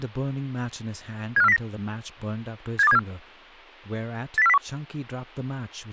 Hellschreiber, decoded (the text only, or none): none